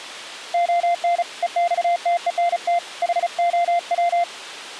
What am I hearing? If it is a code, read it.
Morse code, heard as a keyed tone, hand-sent with a paddle, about 35 wpm, 690 Hz. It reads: ON EXTENT HOW